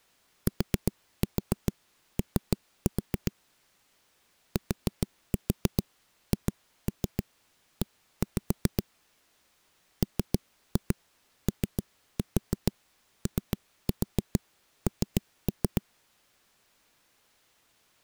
Tap code, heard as knocks on a wall, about 7 knocks a second. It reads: TO THE MOON